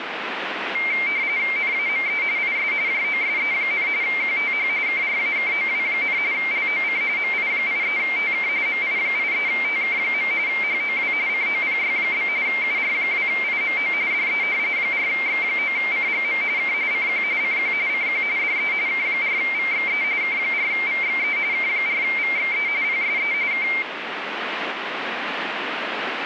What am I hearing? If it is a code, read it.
RTTY (45.45 baud, 170 Hz shift), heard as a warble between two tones, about 2200 Hz centre, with radio static. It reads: NAME IS JOSE, QTH KRAKOW, LOC MI83TK MI83TK. HOW COPY? UR2IMO DE 4X9CGM K CQ CQ CQ DE K4VXE K4VXE K4VXE PSE K